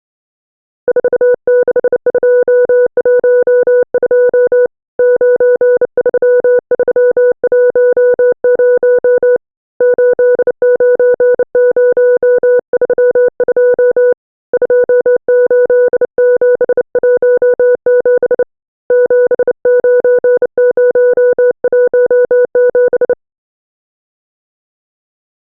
Morse code, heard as a keyed tone, hand-sent with a bug key, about 29 wpm, 490 Hz. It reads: 46212 93310 89032 28717 79017